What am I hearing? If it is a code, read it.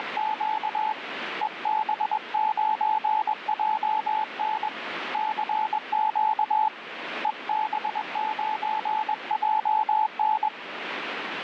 Morse code, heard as a keyed tone, hand-sent with a paddle, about 21 wpm, 870 Hz, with radio static. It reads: … EB9JN CQ EB9JN